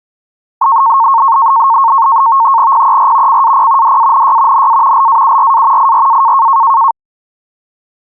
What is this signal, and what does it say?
NAVTEX (SITOR-B), 100 baud, 170 Hz shift, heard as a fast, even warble, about 1000 Hz centre. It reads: PER CAP DANY NA LAURA IRA